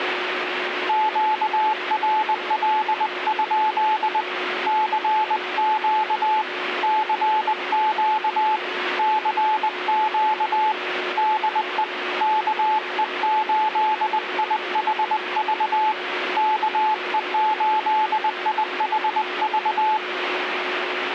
Morse code, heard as a keyed tone, hand-sent with a paddle, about 20 wpm, 860 Hz, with radio static and a steady whistle near 360 Hz. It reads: QRL? CQ CQ CQ DE KE8IHV KE8IHV